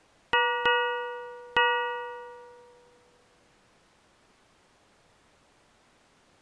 Ship's bell, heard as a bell. 3. Three half-hours of the watch have passed.